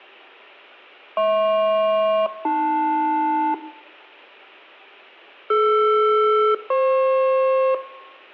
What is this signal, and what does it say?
Aircraft SELCAL, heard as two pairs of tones, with room echo. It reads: HP-AL DR-FP